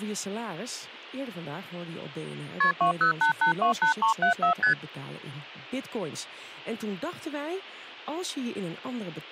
Multi-frequency trunk signalling (R1, as on North American trunks), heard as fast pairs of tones, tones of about 110 ms, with speech in Dutch. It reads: KP 208828374 ST